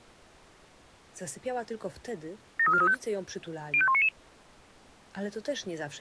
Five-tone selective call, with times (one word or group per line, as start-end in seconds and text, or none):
2.6-2.9 73435
3.7-4.1 05199